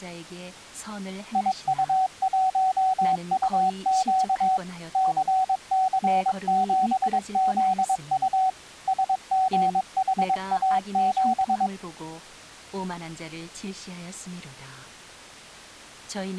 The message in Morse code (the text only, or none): IU1UQ CC7ZU SGHA7